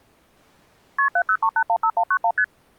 Multi-frequency trunk signalling (R1, as on North American trunks), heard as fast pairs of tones, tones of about 70 ms. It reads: KP 703815191 ST